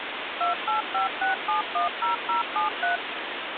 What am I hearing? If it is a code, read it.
DTMF, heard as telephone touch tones, dialled by machine, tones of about 130 ms, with phone line noise. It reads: 2856710073